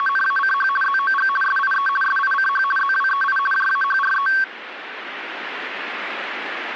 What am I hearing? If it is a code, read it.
RTTY (50 baud, 450 Hz shift), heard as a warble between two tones, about 1340 Hz centre. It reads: … ZOG SIE SICH ZWEI JAHRE